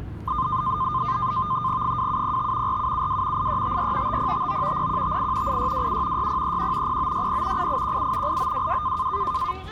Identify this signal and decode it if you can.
NAVTEX (SITOR-B), 100 baud, 170 Hz shift, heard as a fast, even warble, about 1130 Hz centre, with the noise of a residential street. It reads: 2705 4772 8354 5059 0158 8627 6031 0960 8817 8922